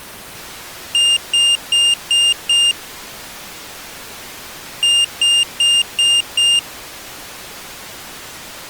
Beep code, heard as a piezo beeper, played twice, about 2800 Hz. 5 short. In AMI BIOS tables: processor failure; in Dell tables: CMOS battery failure.